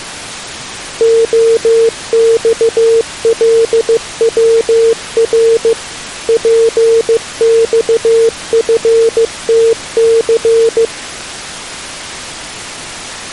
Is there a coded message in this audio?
Yes: Morse code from 0.9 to 10.9 s, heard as a keyed tone, machine-sent, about 15 wpm, 460 Hz. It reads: OXLWR PXFTC